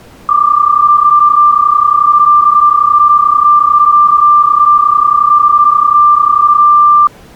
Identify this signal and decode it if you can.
PSK31 (31.25 baud), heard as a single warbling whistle, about 1180 Hz.